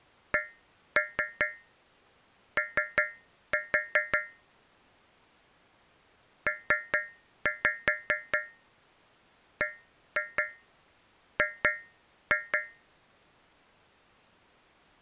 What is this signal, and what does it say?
Tap code, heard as taps on a metal pipe, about 5 knocks a second. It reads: CO PBG